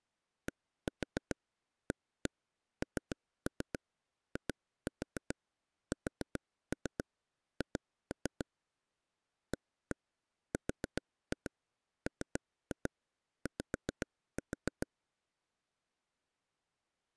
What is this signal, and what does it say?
Tap code, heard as taps on a table, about 7 knocks a second. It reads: DANISH ARMY